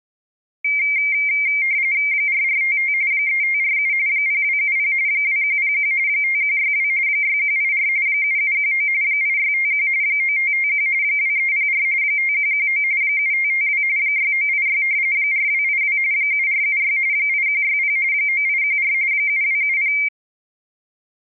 RTTY (45.45 baud, 170 Hz shift), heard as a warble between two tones, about 2200 Hz centre. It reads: 4455 3547 0270 2101 5162 6184 7719 8651 9551 2304 5119 7552 6986 4282 7476 8160 9814 7270